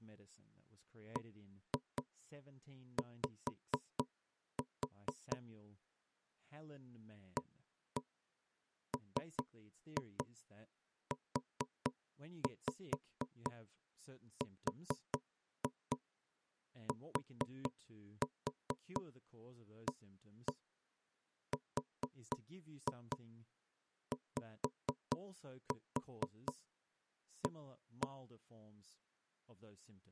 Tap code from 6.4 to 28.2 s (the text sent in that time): AMURTARYA